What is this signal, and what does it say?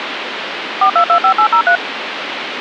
DTMF, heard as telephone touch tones, dialled by machine, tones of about 90 ms, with phone line noise. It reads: 4225803